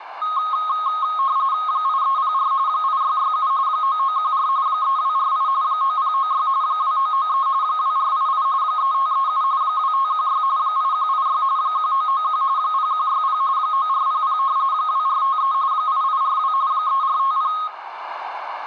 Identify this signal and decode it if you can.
RTTY (45.45 baud, 170 Hz shift), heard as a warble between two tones, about 1170 Hz centre, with radio static and room echo. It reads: 8304 8667 9914 3248 9096 2993 2488 3537 2516 8186 1991 0160 9400 2453 8842 3450